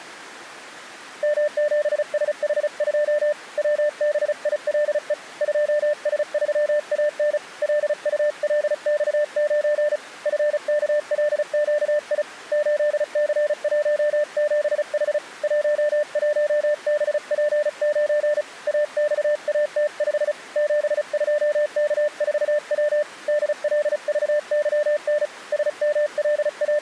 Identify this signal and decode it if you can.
Morse code, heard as a keyed tone, hand-sent with a paddle, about 35 wpm, 600 Hz. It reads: M7SH2 WBILE 2S3AN LULX9 FKLQI 8C17H 11BP9 AXAT5 72K4W DLVYN …